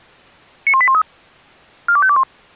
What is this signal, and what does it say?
Five-tone selective call (ZVEI), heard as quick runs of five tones, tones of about 70 ms. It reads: 91813 42521